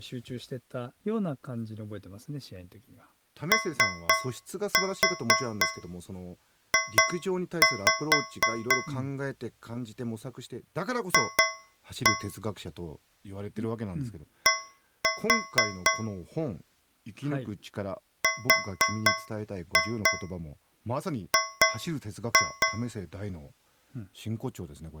Tap code, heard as taps on a metal pipe, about 4 knocks a second, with speech in Japanese. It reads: OJ F D RG